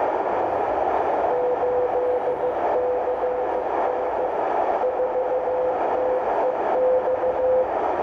Morse code, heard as a keyed tone, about 15 wpm, 500 Hz, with heavy radio static, a narrow filter and the noise of a crowd indoors. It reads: 8CN 4TEX